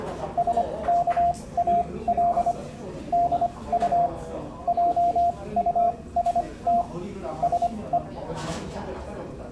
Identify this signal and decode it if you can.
Morse code, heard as a keyed tone, machine-sent, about 25 wpm, spaced as for 19 wpm, 700 Hz, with the noise of a crowd indoors. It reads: SKAL DU JUST SE